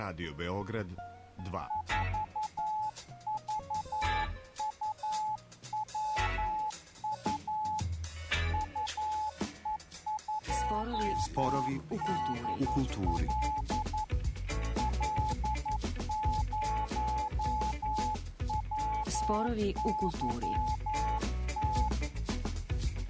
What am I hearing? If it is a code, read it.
Morse code, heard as a keyed tone, hand-sent with a paddle, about 11 wpm, 860 Hz. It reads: 4VUWU UE2DL L0WYT